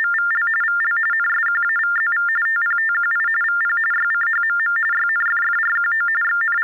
TTY/TDD text telephone tones (45.45 baud Baudot), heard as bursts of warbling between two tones, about 400 Hz shift, 1600 Hz centre. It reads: … VL NSQAVZV TPTQI VP YCHMM YNFFRQO …